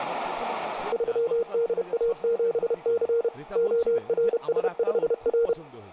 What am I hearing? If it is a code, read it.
Morse code, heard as a keyed tone, machine-sent, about 31 wpm, 470 Hz, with speech in Bangla. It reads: 3DA7C ORS5R